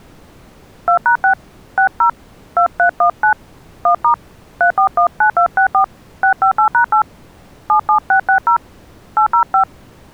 DTMF, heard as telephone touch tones, dialled by hand, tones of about 100 ms. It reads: 2#6 60 2319 1* 3419264 658#8 77660 805